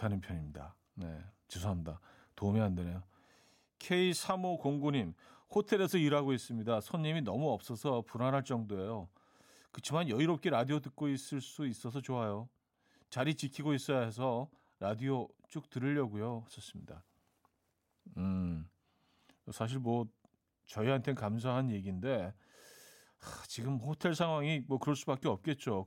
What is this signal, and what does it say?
Speech in Korean. There is no code.